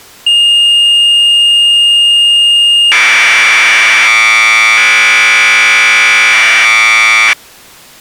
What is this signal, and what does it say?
Commodore tape loading (standard loader), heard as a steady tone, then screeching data.